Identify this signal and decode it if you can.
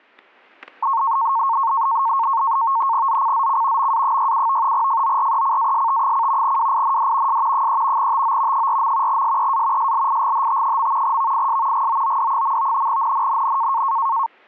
NAVTEX (SITOR-B), 100 baud, 170 Hz shift, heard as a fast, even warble, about 1000 Hz centre, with static crashes. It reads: ZCZC MA67 FORECAST: WIND S 3 TO 4. SEA SLIGHT. VIS GOOD. NNNN